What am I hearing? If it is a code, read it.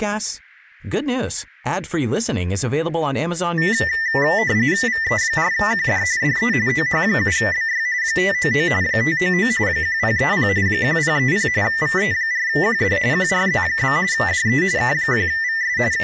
RTTY (45.45 baud, 170 Hz shift), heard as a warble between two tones, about 1900 Hz centre, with speech in Swedish. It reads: VE4QD DE OH7BY 599 599 1030 1030 VE4QD QRZ? DE K1VS …